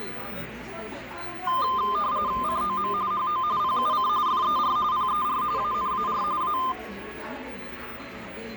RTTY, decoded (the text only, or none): COM HO PUC FER PER ANAR A